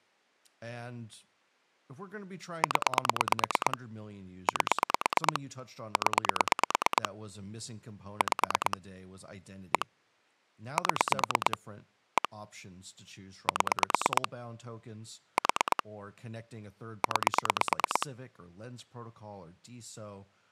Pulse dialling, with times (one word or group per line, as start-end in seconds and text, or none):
2.6-3.8 0
4.5-5.4 8
6.0-7.1 0
8.2-8.8 5
9.7-9.9 1
10.8-11.6 7
12.2-12.3 1
13.5-14.3 7
15.4-15.8 4
17.0-18.1 9